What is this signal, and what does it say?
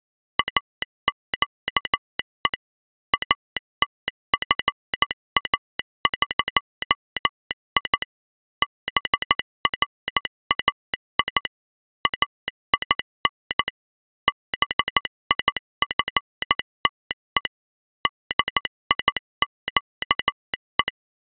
Morse code (Persian alphabet), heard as a telegraph sounder, machine-sent, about 14 wpm. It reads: اگه اتفاقی برای این بیفته دیگه